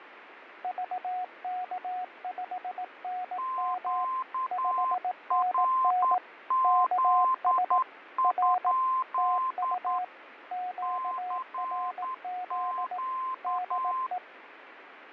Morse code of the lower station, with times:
0.6-4.0 VK5NM
4.5-6.2 5NN
6.6-7.8 KS
8.2-8.7 R
9.2-10.0 TU
10.5-13.0 QRZ
13.4-14.2 DE

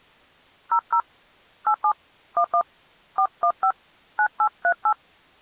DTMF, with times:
0.7-1.0 00
1.7-1.9 87
2.4-2.6 11
3.2-3.7 415
4.2-4.9 9838

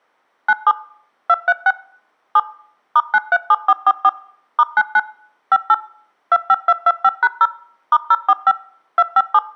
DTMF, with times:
0.5-0.7 97
1.3-1.7 236
2.4-2.4 7
3.0-4.1 *937444
4.6-5.0 *99
5.5-5.7 58
6.3-7.5 25225#0
7.9-8.5 *045
9.0-9.4 257

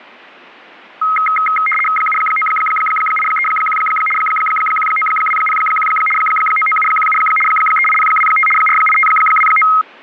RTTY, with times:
2.0-3.8 79831
4.2-5.9 19201
6.2-7.2 99717
7.5-8.5 38025
8.6-9.7 48529

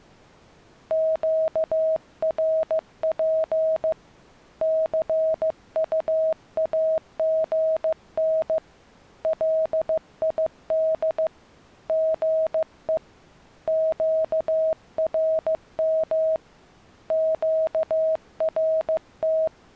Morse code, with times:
0.9-3.9 QRP
4.6-8.6 CUAGN
9.2-11.3 LID
11.9-13.0 GE
13.7-16.4 QRM
17.1-19.5 QRT

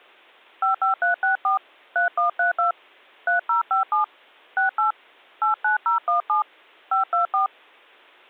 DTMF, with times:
0.6-1.6 55364
2.0-2.7 3132
3.3-4.0 3057
4.6-4.9 68
5.4-6.4 89017
6.9-7.5 524

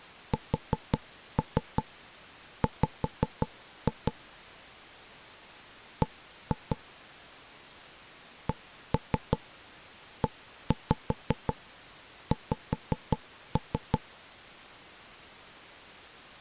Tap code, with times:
0.3-4.1 SW
6.0-6.8 B
8.5-14.0 CEX

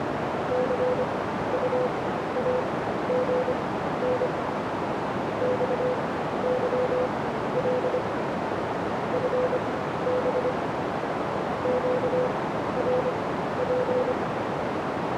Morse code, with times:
0.5-4.3 CUAGN
5.4-8.0 XYL
9.1-10.5 FB
11.6-14.1 QRP

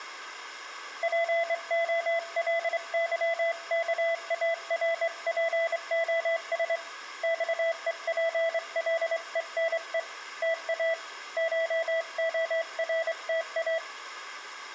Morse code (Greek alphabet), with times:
1.0-6.8 ΠΟΛΥΚΑΡΠΟΣ
7.2-10.0 ΞΕΠΛΕΝΕ
10.4-10.9 ΤΑ
11.4-13.8 ΧΟΡΤΑ

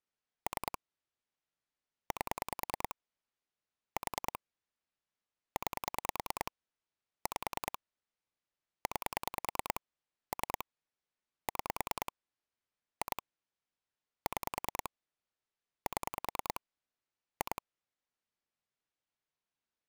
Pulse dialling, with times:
0.5-0.8 3
2.1-3.0 8
4.0-4.4 4
5.6-6.5 9
7.3-7.8 5
8.9-9.8 9
10.3-10.6 3
11.5-12.1 6
13.0-13.2 2
14.3-14.9 6
15.9-16.6 7
17.4-17.6 2

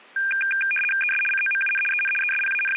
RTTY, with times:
1.0-1.2 ES
1.3-1.8 COMUN
1.9-2.1 EN
2.2-2.8 …

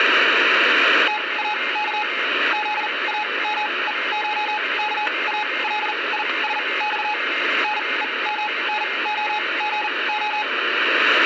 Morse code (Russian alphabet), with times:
1.1-2.0 ТАК
2.5-7.1 ЗАМЕШКАЛИСЬ
7.6-10.4 НЕМНОГО

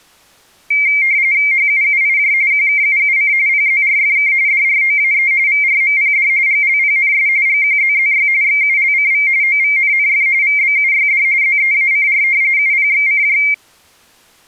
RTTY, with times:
1.5-2.3 HUUIJ
2.5-3.3 QKUUC
3.5-4.3 PZRFK
4.5-5.3 DROAE
5.5-6.3 VRMPD
6.5-7.3 GLPNS
7.5-8.3 GQZZY
8.4-9.3 XULCV
9.4-10.3 OVNNF
10.4-11.2 VBUYD
11.4-12.2 ZEACR
12.6-13.4 UPXCJ

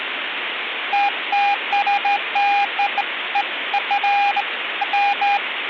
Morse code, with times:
none

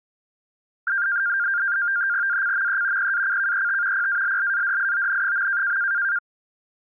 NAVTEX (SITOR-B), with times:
2.3-3.1 ACME
3.0-4.1 PACKET
3.9-5.8 PALLADION.

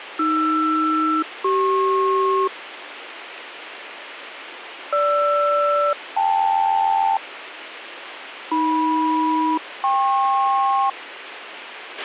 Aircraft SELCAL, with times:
0.2-2.5 AR-CP
4.9-7.2 GR-KL
8.5-10.9 AM-KP

